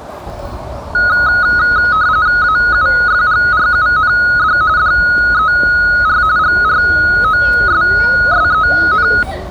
RTTY (45.45 baud, 170 Hz shift), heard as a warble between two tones, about 1360 Hz centre, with the noise of a residential street. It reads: AUFGRUND DER GROSSEN